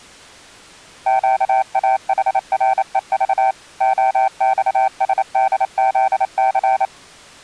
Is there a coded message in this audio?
Yes: Morse code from 1.0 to 6.9 s, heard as a keyed tone, machine-sent, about 28 wpm, 770 Hz. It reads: QAHREV OXSDZC